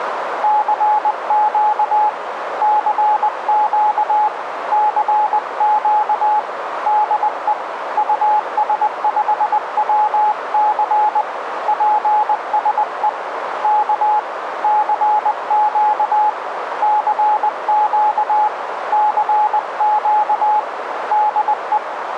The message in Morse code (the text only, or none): CQ CQ CQ DE US5WC PSE K CQ CQ CQ DE